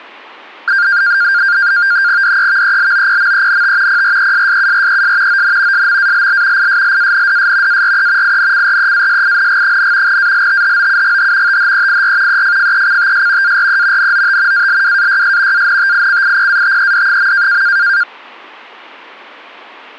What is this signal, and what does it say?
NAVTEX (SITOR-B), 100 baud, 170 Hz shift, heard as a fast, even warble, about 1500 Hz centre. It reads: DEVELOPMENT PRESSURES ON SMALL ISLANDS ARE INCREASING, ALTHOUGH THEIR EFFECTS ARE NOT ALWAYS ANTICIPATED.